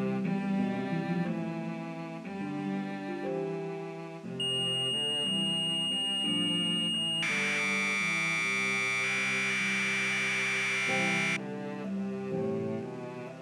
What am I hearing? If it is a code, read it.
Commodore tape loading (standard loader), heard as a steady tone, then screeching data.